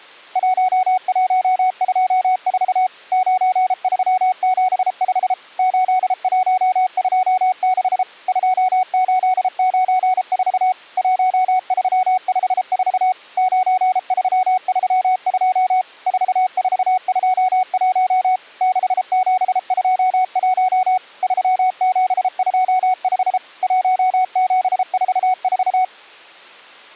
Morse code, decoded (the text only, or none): 1124 9375 8126 2894 1354 9332 4421 6721 3725 1744